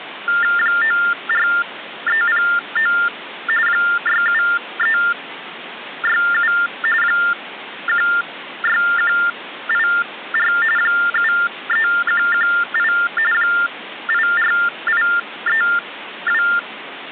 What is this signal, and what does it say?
TTY/TDD text telephone tones (45.45 baud Baudot), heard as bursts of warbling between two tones, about 400 Hz shift, 1600 Hz centre, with phone line noise. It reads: 94309 67367 16184 73118 84832